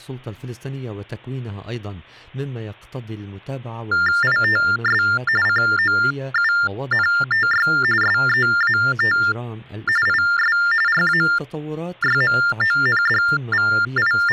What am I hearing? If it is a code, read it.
TTY/TDD text telephone tones (45.45 baud Baudot), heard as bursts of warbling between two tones, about 400 Hz shift, 1600 Hz centre. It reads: ITS COUNTY SEAT IS …